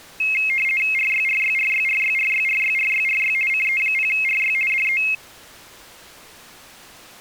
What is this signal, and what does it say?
RTTY (50 baud, 450 Hz shift), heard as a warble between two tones, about 2350 Hz centre. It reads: RYRYRYRYRYRYRYRY CE0RY DE